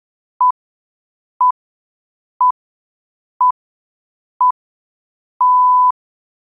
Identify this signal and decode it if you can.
Radio time signal (six pips, as the Greenwich Time Signal), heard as pips.